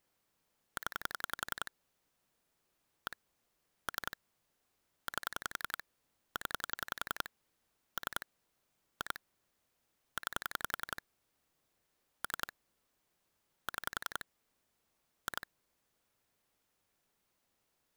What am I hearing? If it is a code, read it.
Pulse dialling, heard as clicks on a phone line, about 11 pulses a second. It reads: 0 1 3 8 0 3 2 9 3 6 2